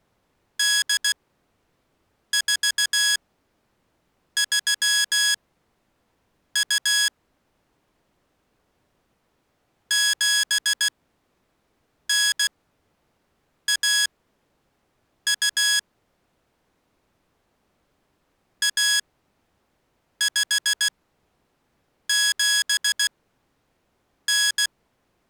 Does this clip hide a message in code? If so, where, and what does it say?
Yes: Morse code (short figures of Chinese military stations) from 0.5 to 24.7 s, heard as electronic beeps, machine-sent, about 16 wpm, spaced as for 6 wpm, 1650 Hz. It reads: 8432 7912 1579